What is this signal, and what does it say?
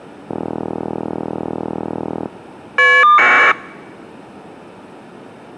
Caller ID data burst, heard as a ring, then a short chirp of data, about 1200 baud.